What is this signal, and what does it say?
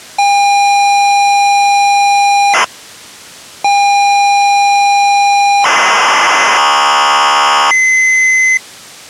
ZX Spectrum tape loading, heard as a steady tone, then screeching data.